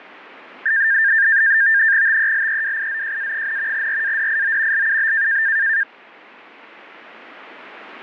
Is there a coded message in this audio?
Yes: NAVTEX (SITOR-B), 100 baud, 170 Hz shift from 0.7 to 5.8 s, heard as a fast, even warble, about 1700 Hz centre. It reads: TELEWIZJA, RADIO LUB